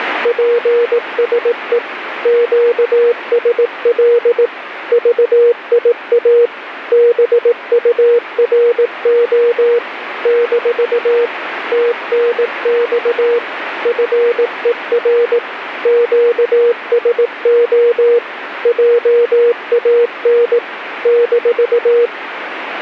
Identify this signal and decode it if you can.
Morse code, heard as a keyed tone, machine-sent, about 18 wpm, 480 Hz, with radio static. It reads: PSE QSL VIA BURO - TNX FER QSO JAN -